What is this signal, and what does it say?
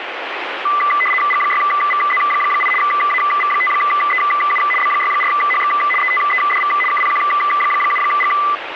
RTTY (75 baud, 850 Hz shift), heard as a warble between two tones, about 1600 Hz centre, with radio static. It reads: G6VZ8 AV5EU B64HX ETEDV KPQ7G